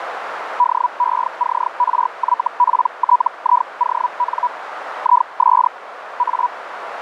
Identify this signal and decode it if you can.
Hellschreiber (Feld-Hell, 122.5 baud), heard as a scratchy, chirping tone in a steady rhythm, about 980 Hz, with radio static and a narrow filter. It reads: DECRYPTION IS A